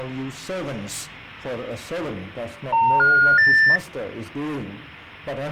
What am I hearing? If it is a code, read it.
Telephone call progress tone (North American plan), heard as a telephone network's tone, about 910, 1430, 1800 Hz. Special information tone.